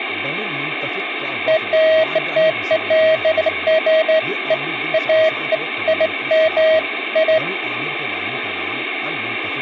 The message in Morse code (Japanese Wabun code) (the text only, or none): none